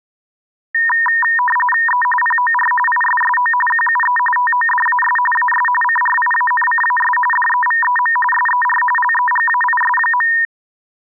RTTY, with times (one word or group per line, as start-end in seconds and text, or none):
1.9-2.0 E
2.2-2.7 POR
2.9-3.5 ISSO
3.7-4.2 QUE
4.4-5.2 TODAS
5.4-5.7 AS
5.8-7.2 CRIANCAS
7.3-8.2 DEVEM
8.3-8.8 SER
9.0-10.3 LEGAIS.